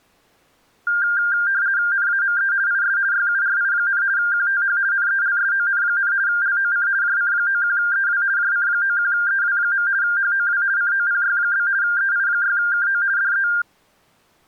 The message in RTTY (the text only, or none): NAME IS YURI, QTH NELSON, LOC JC91EW JC91EW. HOW COPY? EI6KO DE